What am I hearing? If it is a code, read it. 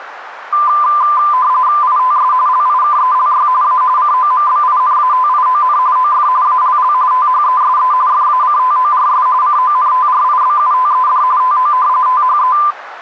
RTTY (45.45 baud, 170 Hz shift), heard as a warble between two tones, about 1100 Hz centre, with radio static. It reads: ITS LIKELY A COMBINATION OF ALL THESE FACTORS CONTRIBUTED TO THE